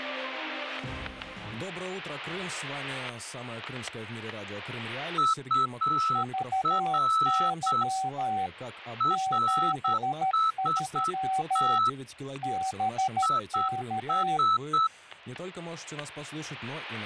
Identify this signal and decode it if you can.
Morse code, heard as two keyed tones, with static crashes. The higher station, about 8 wpm, 1310 Hz: UR RST IS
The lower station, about 13 wpm, 760 Hz: VY 73 BK